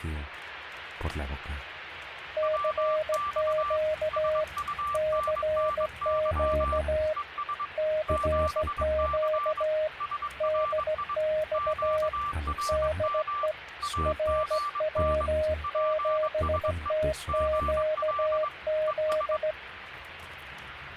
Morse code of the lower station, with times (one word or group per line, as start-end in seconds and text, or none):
2.4-4.4 CQ
4.9-7.1 CQ
7.8-9.9 CQ
10.4-12.1 DX
12.7-13.5 DE
14.1-19.5 RW7TQZ